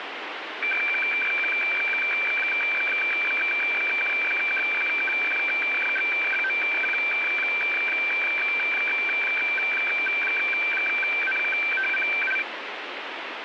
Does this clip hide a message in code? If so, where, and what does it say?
Yes: weather fax (radiofax), 120 lines a minute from 0.6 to 12.4 s, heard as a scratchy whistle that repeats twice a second, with radio static.